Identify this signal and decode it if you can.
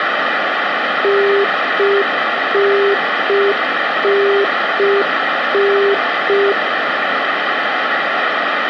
Telephone call progress tone (UK plan), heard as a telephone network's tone, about 400 Hz, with phone line noise. Congestion tone.